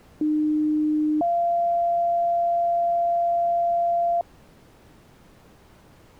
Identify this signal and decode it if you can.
Two-tone page, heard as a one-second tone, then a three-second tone, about 300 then 690 Hz.